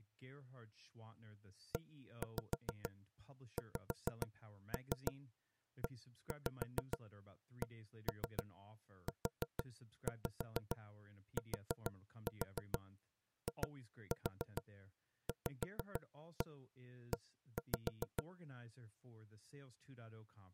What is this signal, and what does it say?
Tap code, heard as knocks on wood, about 6 knocks a second, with speech in English. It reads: EXECUTIVE